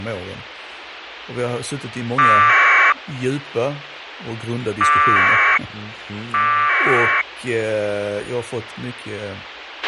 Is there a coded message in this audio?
Yes: packet radio (AX.25, as in APRS), 1200 baud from 2.2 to 7.2 s, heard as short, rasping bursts, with radio hiss, a squelch burst at the end and speech in Swedish.